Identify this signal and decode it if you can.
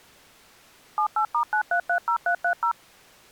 DTMF, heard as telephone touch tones, dialled by machine, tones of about 90 ms. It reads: 78*9330330